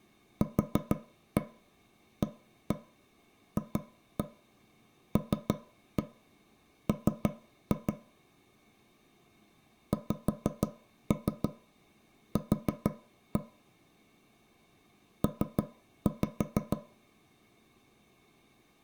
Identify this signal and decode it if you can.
Tap code, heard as taps on a table, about 6 knocks a second. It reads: QAFLM XQ P